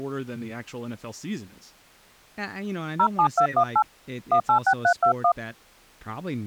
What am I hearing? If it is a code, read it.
DTMF, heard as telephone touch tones, dialled by hand, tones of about 70 ms, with speech in English. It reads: 07218 186321